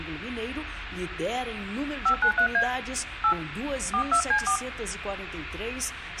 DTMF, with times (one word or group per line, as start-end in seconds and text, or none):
2.1-2.6 593A
3.2-3.3 8
3.9-4.6 42C4